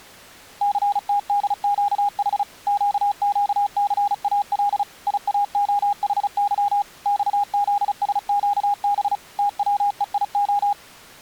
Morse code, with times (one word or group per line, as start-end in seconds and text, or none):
0.6-2.4 CTDQH
2.7-4.8 QQCAL
5.1-6.8 IAOHY
7.1-9.2 XZSQB
9.4-10.7 TWEIO